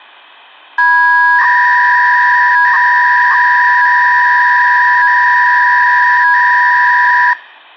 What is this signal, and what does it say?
300-baud modem data (V.21 tones), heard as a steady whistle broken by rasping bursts, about 300 baud, 200 Hz shift.